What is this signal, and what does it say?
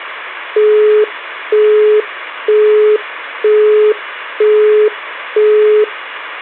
Telephone call progress tone (single-tone plan, as in Europe, Japan and elsewhere), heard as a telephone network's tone, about 420 Hz, 0.48 s on and 0.48 s off. Busy tone.